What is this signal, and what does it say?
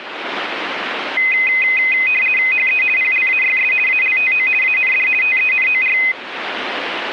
RTTY (50 baud, 450 Hz shift), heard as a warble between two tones, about 2300 Hz centre, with radio static. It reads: HE PLAYS ALTO AND TENOR